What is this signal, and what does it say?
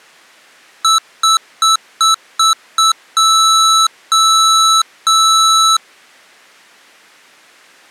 Beep code, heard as beeps from a small speaker, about 1310 Hz. 6 short, 3 long.